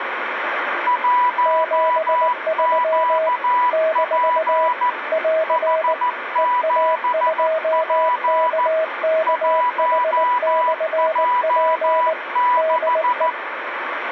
Morse code, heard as two keyed tones, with radio static. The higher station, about 14 wpm, 990 Hz: 1QP H7P 1J6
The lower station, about 19 wpm, 640 Hz: 73 - <AR> EA2KKH/P DE